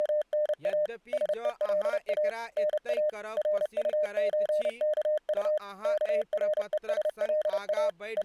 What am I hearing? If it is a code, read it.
Morse code (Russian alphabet), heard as a keyed tone, machine-sent, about 30 wpm, 610 Hz, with speech in Maithili. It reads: … СЕЛА НА РУЧКУ КРЕСЛА …